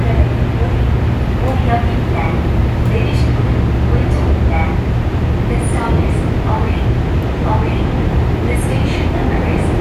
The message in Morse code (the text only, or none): none